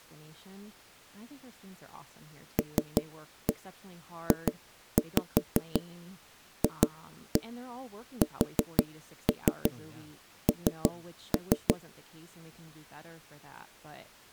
Tap code, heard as knocks on wood, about 5 knocks a second, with speech in English. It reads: LJFSN